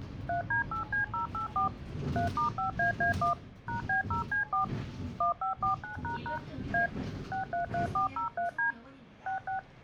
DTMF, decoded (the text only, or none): 3D8C084 3*5AA1 #B0C4 1549## A 633403D 66